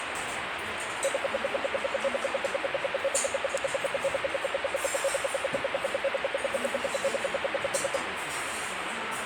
Radio time signal (RWM, Moscow), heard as ten pulses a second, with radio static and the noise of a restaurant.